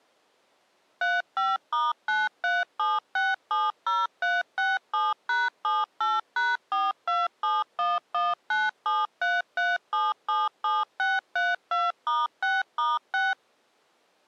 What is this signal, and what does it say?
DTMF, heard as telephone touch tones, dialled by machine, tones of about 190 ms. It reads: 35*937670367#78#427119733777632*6*6